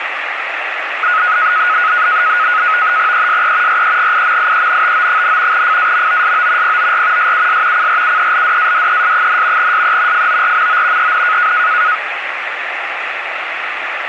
NAVTEX (SITOR-B), 100 baud, 170 Hz shift, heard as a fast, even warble, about 1360 Hz centre, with radio static. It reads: ESE REGIMIENTO, FAMOSO POR SUS CRUELDADES, SE FORMO EN